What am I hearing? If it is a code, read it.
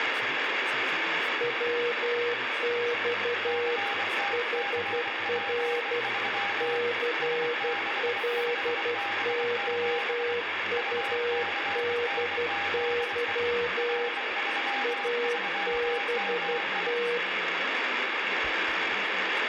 Morse code, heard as two keyed tones, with radio static and speech in German. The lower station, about 12 wpm, 480 Hz: WX HR CLOUDY ABT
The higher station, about 24 wpm, 800 Hz: CTCP3 S65B7 UCNZE R33MI